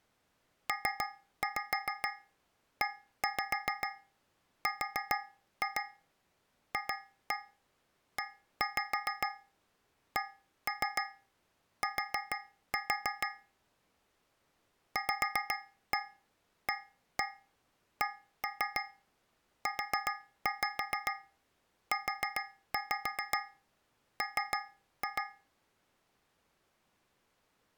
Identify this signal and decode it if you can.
Tap code, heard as taps on a metal pipe, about 7 knocks a second. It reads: PERFECT VACUUM